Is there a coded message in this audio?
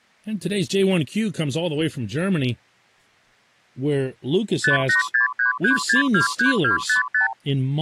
Yes: multi-frequency trunk signalling (R2, with the far end's replies) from 4.6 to 7.3 s, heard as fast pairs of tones, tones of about 120 ms, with speech in English. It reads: 58633623255